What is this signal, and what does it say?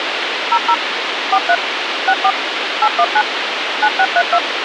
DTMF, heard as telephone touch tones, dialled by machine, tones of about 60 ms, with radio hiss and a squelch burst at the end. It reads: 00 43 64 819 9632